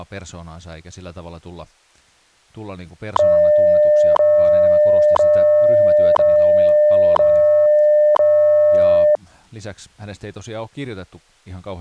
Radio time signal (WWV, Colorado), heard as ticks, one a second, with speech in Finnish.